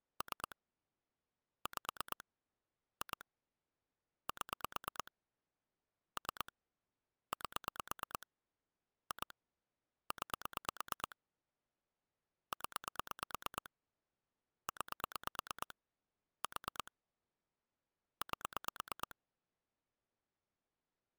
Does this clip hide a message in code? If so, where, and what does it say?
Yes: pulse dialling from 0.2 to 19.1 s, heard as clicks on a phone line, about 9 pulses a second. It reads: 3 5 2 7 3 8 2 9 0 9 4 8